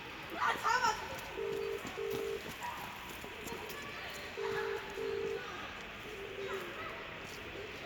Telephone call progress tone (as in the UK, Ireland, Australia and similar networks), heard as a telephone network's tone, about 400, 450 Hz, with phone line noise, room echo and the noise of a park. Ringback tone.